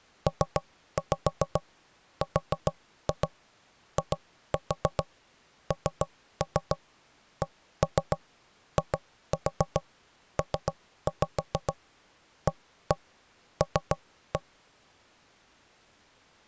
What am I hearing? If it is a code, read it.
Tap code, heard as knocks on wood, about 7 knocks a second. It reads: PRINCIPAL